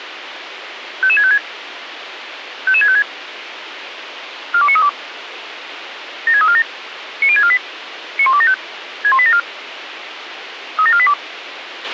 Five-tone selective call (ZVEI), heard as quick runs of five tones, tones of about 70 ms, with radio hiss and a squelch burst at the end. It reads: 55656 55656 42932 76347 90648 91275 61874 37482